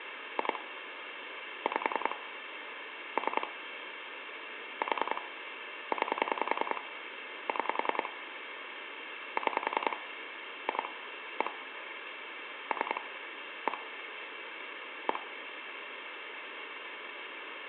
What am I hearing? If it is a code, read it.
Pulse dialling, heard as clicks on a phone line, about 10 pulses a second, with phone line noise. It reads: 2 5 3 4 9 6 6 2 1 3 1 1